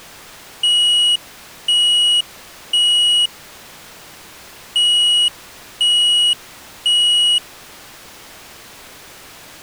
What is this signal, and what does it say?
Alarm pattern, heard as an alarm's beeps, played twice, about 2900 Hz. Temporal three. Smoke or fire, evacuate.